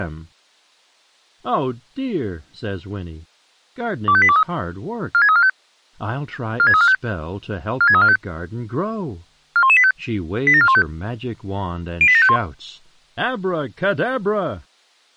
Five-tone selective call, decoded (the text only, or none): 25823 46345 46345 46345 41185 87415 08751